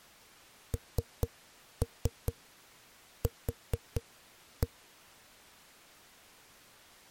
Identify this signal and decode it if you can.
Tap code, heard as knocks on a wall, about 4 knocks a second. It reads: NQ